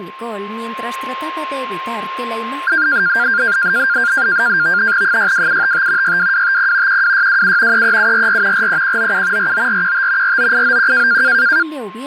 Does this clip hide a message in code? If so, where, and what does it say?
Yes: NAVTEX (SITOR-B), 100 baud, 170 Hz shift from 2.7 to 11.6 s, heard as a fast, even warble, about 1500 Hz centre, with a steady whistle near 1060 Hz. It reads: 62755 62250 12627 33744 43197 49415 49891